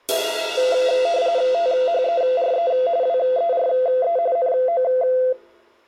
RTTY (45.45 baud, 170 Hz shift), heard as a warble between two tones, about 600 Hz centre. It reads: THERE WERE NO